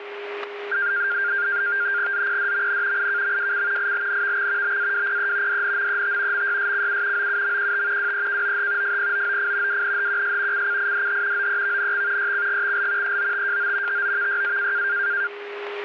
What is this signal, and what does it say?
NAVTEX (SITOR-B), 100 baud, 170 Hz shift, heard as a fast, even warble, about 1500 Hz centre, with radio static, static crashes and a steady whistle near 410 Hz. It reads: ZPDMN IKMWC ILNVX BAWPE DNMET MYSCU OUMQT WEKOH FPOOF WNHQS CCIDH OEVNX YCGXL EOTJO TOVYA